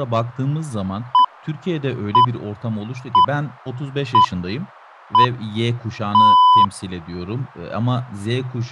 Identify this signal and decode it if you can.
Radio time signal (six pips, as the Greenwich Time Signal), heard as pips, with speech in Turkish.